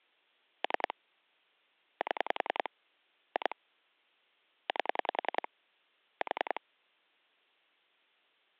Pulse dialling, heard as clicks on a phone line, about 10 pulses a second. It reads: 3 7 2 8 4